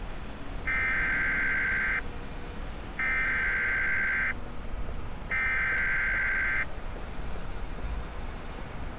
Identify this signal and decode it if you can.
Emergency Alert System (SAME) tones (header bursts), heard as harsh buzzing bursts, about 520.83 baud, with street noise.